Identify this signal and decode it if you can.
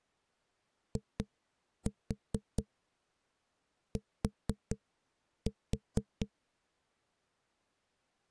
Tap code, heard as knocks on a wall, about 4 knocks a second. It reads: IT